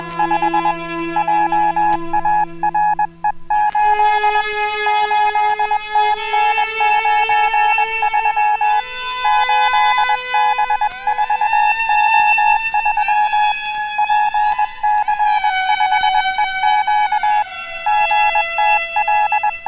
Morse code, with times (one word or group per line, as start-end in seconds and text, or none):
0.0-0.7 …
1.2-4.4 JARE8
4.9-8.8 8TN93
9.2-13.5 8B4O3
14.0-17.4 PC5EQ
17.9-19.7 …